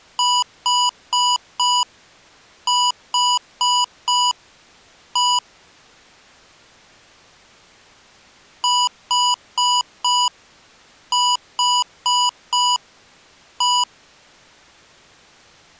Beep code, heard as beeps from a small speaker, played twice, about 980 Hz. 4-4-1. In Phoenix BIOS tables: serial port failure.